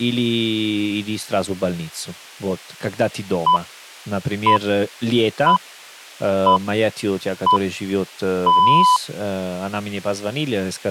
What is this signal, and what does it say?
Radio time signal (six pips, as the Greenwich Time Signal), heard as pips, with speech in Russian.